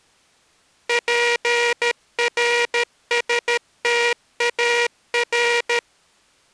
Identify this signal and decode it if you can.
Morse code (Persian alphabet), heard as a buzzer, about 13 wpm. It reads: پرستار